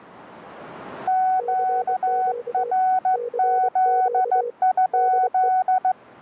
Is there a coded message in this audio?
Yes: Morse code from 1.0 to 6.0 s, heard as two keyed tones. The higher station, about 15 wpm, 750 Hz: QRZ?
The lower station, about 24 wpm, 480 Hz: CQ CQ DE